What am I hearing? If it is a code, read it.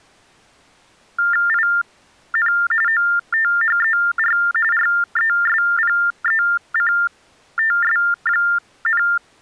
TTY/TDD text telephone tones (45.45 baud Baudot), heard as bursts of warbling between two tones, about 400 Hz shift, 1600 Hz centre. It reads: IN OTHER RESPECTS,